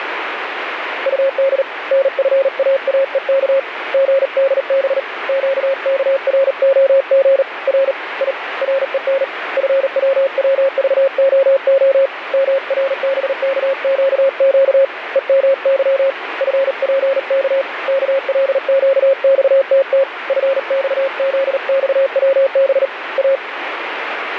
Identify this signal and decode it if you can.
Morse code, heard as a keyed tone, hand-sent with a paddle, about 38 wpm, 540 Hz, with radio static. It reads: UD NFAAEK GDB QKROG R I REN FWWVOO MRBKQQ EMY FPK KLQXTT FXZXWB A